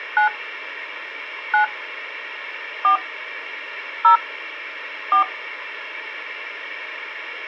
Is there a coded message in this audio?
Yes: DTMF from 0.2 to 5.2 s, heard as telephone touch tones, dialled by hand, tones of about 110 ms. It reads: 9 9 4 0 4